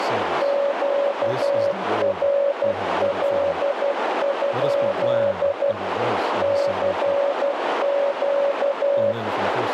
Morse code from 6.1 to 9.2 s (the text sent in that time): CQ